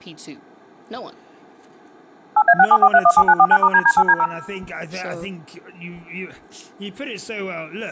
DTMF, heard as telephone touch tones, dialled by machine, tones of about 60 ms, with speech in English. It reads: 8A674317949*DD8D0